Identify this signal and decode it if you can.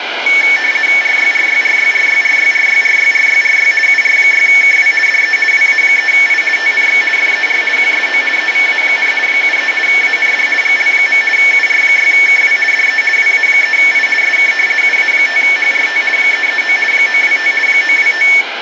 RTTY (50 baud, 450 Hz shift), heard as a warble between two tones, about 2000 Hz centre, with radio static and room echo. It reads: RYRYRYRYRYRYRYRYRY UR6KW DE WA3I TNX FER QSO EVA, 73 AND GL. UR6KW DE WA3I SK UA5HRT 339 925 925